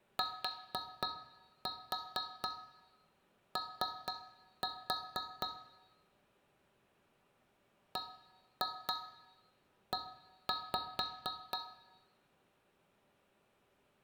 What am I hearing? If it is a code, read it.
Tap code, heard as taps on a metal pipe, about 4 knocks a second, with room echo. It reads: TO BE